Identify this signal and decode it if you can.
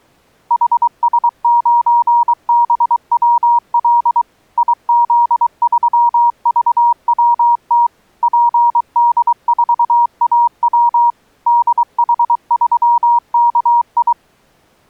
Morse code, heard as a keyed tone, machine-sent, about 23 wpm, 950 Hz. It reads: HS9BWL IZ3VWT PD4AW DH3KI